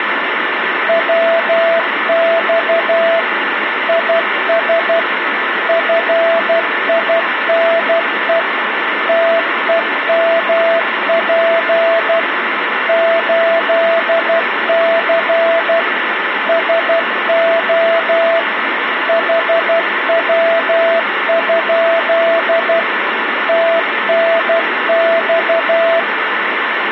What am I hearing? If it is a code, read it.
Morse code, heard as a keyed tone, machine-sent, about 12 wpm, 660 Hz, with radio static and a steady whistle near 1760 Hz. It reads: WX IS FINE TEMP 8C SO HW? TNX